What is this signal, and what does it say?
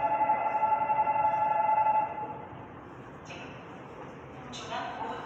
The noise of a subway station. There is no code.